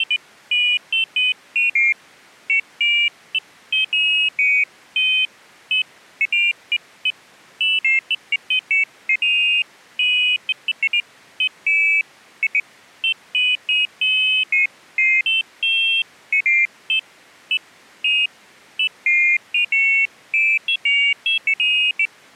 Pairs of high tones at irregular times. There is no code.